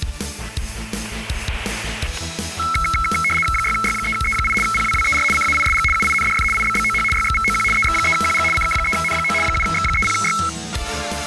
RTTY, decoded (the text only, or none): 6Y3E8 PWWER CAISG UINDF IBBOH YXVOQ EX3QG CK3N9 7X30Y